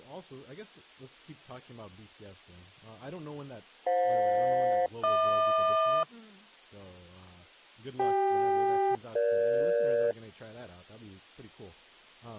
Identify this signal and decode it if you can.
Aircraft SELCAL, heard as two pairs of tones, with speech in English. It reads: FJ-HQ CK-EG